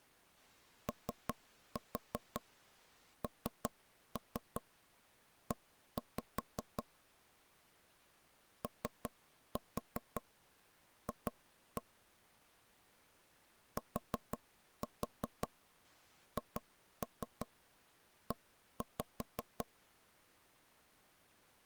Tap code, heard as taps on a table, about 5 knocks a second. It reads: ONE OF THE